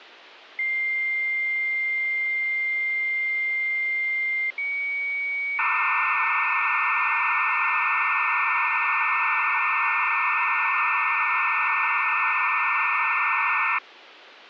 Dial-up modem handshake (low-speed, two carriers), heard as two whistles, then hiss, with phone line noise.